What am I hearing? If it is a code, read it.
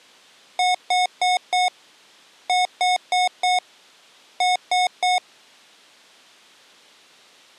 Beep code, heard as beeps from a small speaker, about 730 Hz. 4-4-3. In Phoenix BIOS tables: maths coprocessor failure.